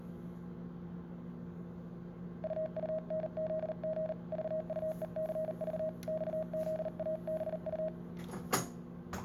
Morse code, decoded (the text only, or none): UUNZG VUECV XZABU